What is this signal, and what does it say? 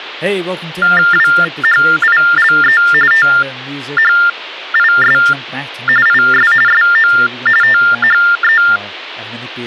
TTY/TDD text telephone tones (45.45 baud Baudot), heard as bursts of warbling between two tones, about 400 Hz shift, 1600 Hz centre, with speech in English. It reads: WHILE THIS IS SO THE